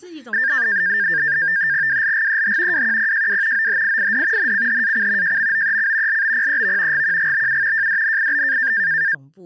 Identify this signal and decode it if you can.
NAVTEX (SITOR-B), 100 baud, 170 Hz shift, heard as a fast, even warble, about 1700 Hz centre, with speech in Chinese. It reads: WLGEH WQPJW OHIID NCHAC JMOEC LBPEV GQGBU JDNIB